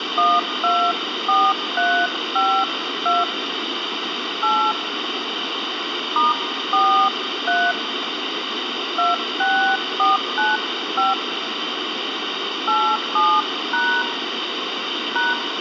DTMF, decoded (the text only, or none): 124352 8 *43 26495 87# #